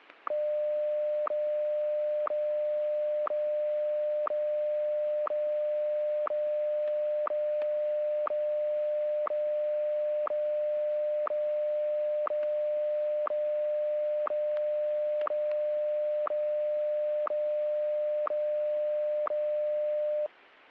Radio time signal (WWVH, Hawaii), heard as ticks, one a second, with static crashes.